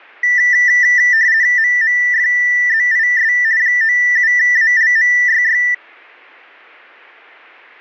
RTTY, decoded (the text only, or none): MMFZIS 97ALMYY